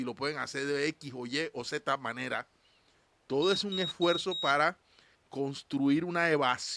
Beep code, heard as a piezo beeper, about 3800 Hz, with speech in Spanish. 4 short. In AMI BIOS tables: system timer failure; in Dell tables: memory read or write failure.